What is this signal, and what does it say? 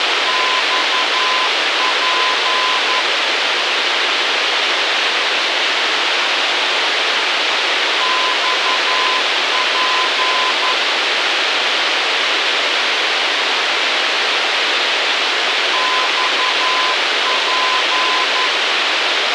Morse code, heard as a keyed tone, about 11 wpm, 1020 Hz, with radio hiss. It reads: XP XP XP